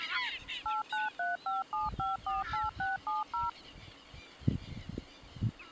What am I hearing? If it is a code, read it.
DTMF, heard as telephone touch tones, dialled by machine, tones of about 160 ms. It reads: 89357548670